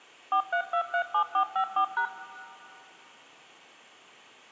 DTMF, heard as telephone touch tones, dialled by machine, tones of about 90 ms, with room echo. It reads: 43237454#